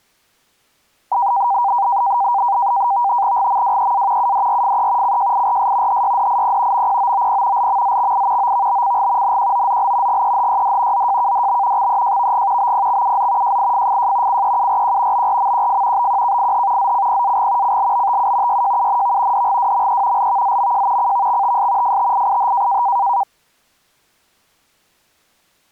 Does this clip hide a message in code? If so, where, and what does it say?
Yes: NAVTEX (SITOR-B), 100 baud, 170 Hz shift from 1.1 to 23.2 s, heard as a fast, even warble, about 880 Hz centre. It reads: GMWEA UDRFE CJIRS HYDIP MPOOP LMZXI OVBCG NQOZL GEHYD ZJKDB XEJVG BPXUZ JIFFJ CEURQ BRMQF BQKIH ZCPAG CLBTU YJUNV DGWME LVZMJ CVXTS FTIIH